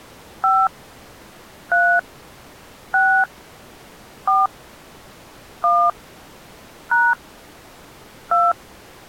DTMF, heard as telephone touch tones, dialled by hand, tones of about 250 ms. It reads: 5 3 6 4 1 # 2